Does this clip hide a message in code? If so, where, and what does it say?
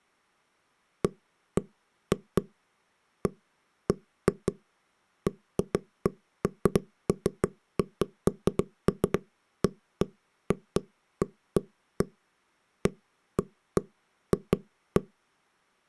No, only irregular knocks on wood.